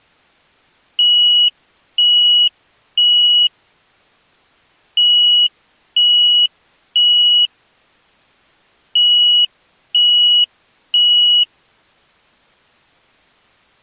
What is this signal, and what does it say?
Alarm pattern, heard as an alarm's beeps, played three times, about 2900 Hz. Temporal three. Smoke or fire, evacuate.